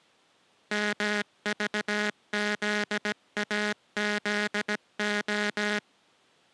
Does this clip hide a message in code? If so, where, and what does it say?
Yes: Morse code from 0.7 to 5.8 s, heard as a buzzer, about 17 wpm. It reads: MVZAZO